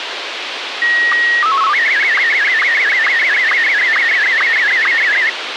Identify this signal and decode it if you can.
SSTV (slow-scan television), Martin M1, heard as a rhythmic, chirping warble, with radio hiss.